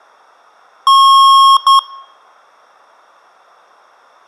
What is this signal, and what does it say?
Beep code, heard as beeps from a small speaker, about 1090 Hz. 1 long, 1 short. In IBM BIOS tables: system board problem.